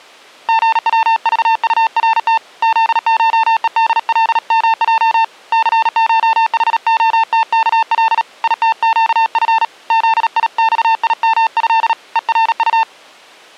Morse code (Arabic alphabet), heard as a keyed tone, hand-sent with a paddle, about 37 wpm, 900 Hz. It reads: غوضطرت ذشءدلمج ثشحختكل يتقف ذيصيمه ءرط